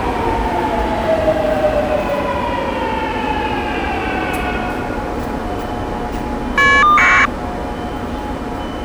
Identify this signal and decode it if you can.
Caller ID data burst, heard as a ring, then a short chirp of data, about 1200 baud, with the noise of a subway station.